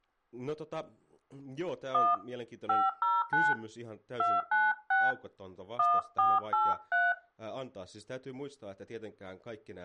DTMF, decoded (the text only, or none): 1 509 296 1483